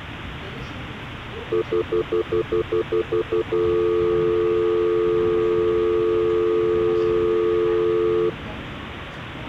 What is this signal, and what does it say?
Telephone call progress tone (North American plan), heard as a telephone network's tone, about 350, 440 Hz, 0.1 s on and 0.1 s off, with hum and the noise inside a subway train. Stutter dial tone.